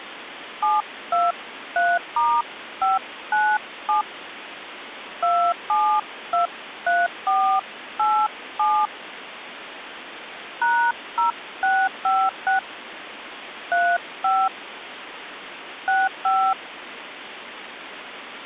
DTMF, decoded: 723*597 2723487 #0656 35 65

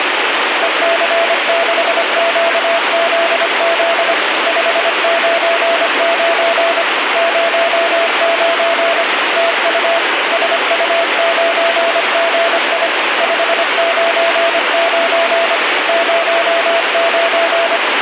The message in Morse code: EC6QZZ 599 09 TU SU9GI 599 09

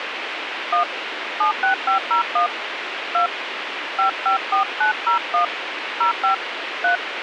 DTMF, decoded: 1 76501 2 554901 05 3

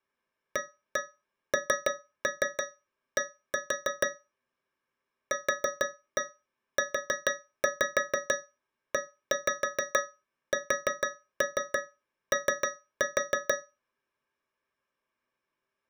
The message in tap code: AND QUESO

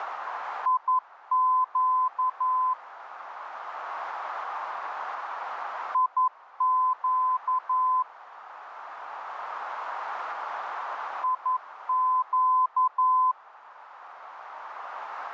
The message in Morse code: IQ IQ IQ

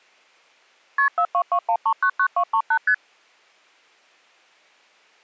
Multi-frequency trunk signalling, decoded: KP 4221399238 ST

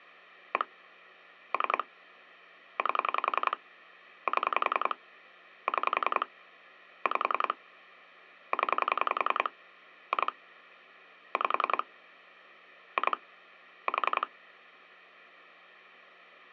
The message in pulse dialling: 1 3 8 7 6 5 0 2 5 2 4

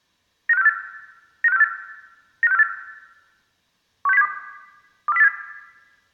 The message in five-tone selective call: 95648 95648 95648 16072 24087

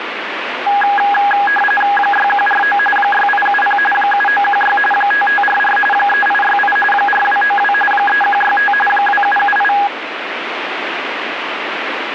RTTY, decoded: 6149 6870 7916 5544 3868 4292 3165 2778

